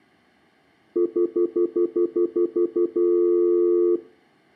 Telephone call progress tone (North American plan), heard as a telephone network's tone, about 350, 440 Hz, 0.1 s on and 0.1 s off, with room echo. Stutter dial tone.